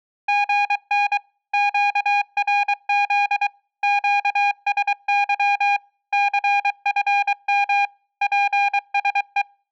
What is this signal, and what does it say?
Morse code, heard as a keyed tone, machine-sent, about 23 wpm, 810 Hz. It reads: GN QRZ QSY CFM PSE